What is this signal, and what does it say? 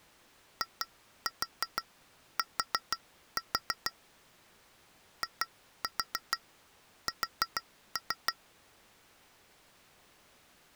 Tap code, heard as taps on glass, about 6 knocks a second. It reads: IT IS